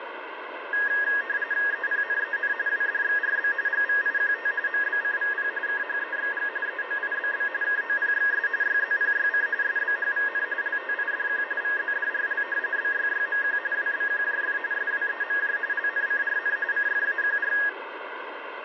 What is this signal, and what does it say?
RTTY (45.45 baud, 170 Hz shift), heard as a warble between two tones, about 1750 Hz centre, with radio static and room echo. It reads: EPNEN WDXRB GVIQT MBCVP KHEXG EOIBB KOPXS YZPYC SBHVN LTIDQ VZDRL BYYMQ WBQJF SWEMJ LNCRN CFAQR